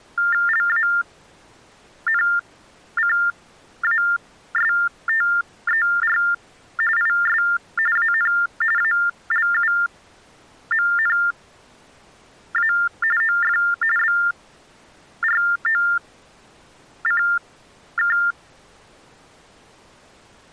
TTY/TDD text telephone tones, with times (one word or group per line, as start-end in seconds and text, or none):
0.5-6.2 LANCASTER
7.0-7.4 IS
8.0-8.3 AN
8.8-12.7 ALUMNA
13.2-13.6 OF
14.0-18.2 BROCK